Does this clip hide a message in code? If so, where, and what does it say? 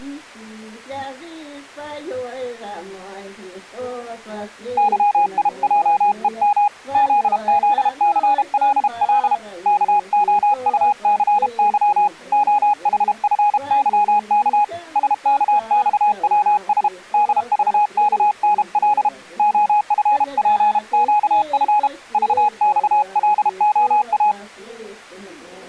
Yes: Morse code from 4.7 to 24.4 s, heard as a keyed tone, hand-sent with a paddle, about 32 wpm, 830 Hz. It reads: YIJEM ZZCLL KOUCY OHFYK SKXWS DVKNL OFPQF VXLOA